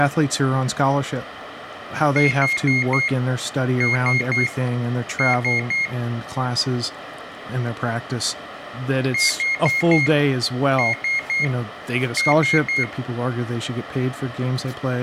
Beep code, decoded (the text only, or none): 4-3-3